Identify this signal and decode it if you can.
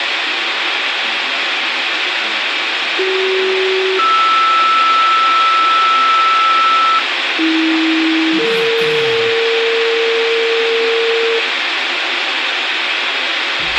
Two-tone page, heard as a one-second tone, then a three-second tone, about 380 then 1320 Hz, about 320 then 460 Hz, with radio hiss and a squelch burst at the end.